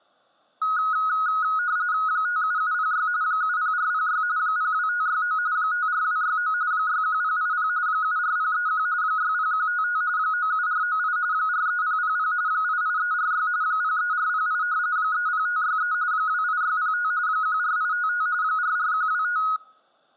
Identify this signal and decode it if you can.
RTTY (45.45 baud, 170 Hz shift), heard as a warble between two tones, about 1360 Hz centre. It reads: 57706 70406 02569 54269 61080 74031 60155 97498 43000 88346 03408 30563 28605 14855 44125